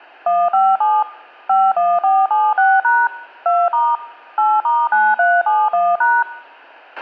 DTMF, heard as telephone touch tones, dialled by machine, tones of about 220 ms, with a squelch burst at the end. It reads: 157 51476# 2* 8*9371#